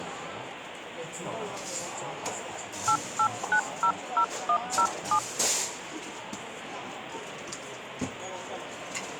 DTMF, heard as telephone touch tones, dialled by hand, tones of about 80 ms, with the noise of a cafe. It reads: 88900107